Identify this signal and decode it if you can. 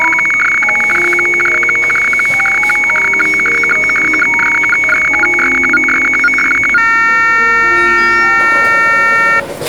Weather fax (radiofax), 120 lines a minute, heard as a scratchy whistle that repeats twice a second, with the noise of a crowd indoors.